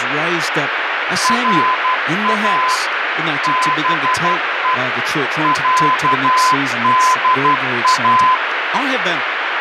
Morse code (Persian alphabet), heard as a keyed tone, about 12 wpm, 1020 Hz, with heavy radio static and speech in English. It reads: را به صدا